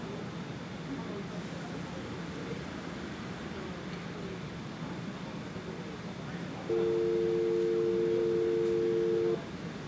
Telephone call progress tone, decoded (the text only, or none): dial tone